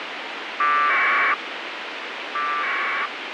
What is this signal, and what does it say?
Packet radio (AX.25, as in APRS), 1200 baud, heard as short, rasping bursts, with radio hiss.